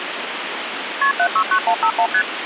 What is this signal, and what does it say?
Multi-frequency trunk signalling (R1, as on North American trunks), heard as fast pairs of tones, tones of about 80 ms, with phone line noise. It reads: KP 769151 ST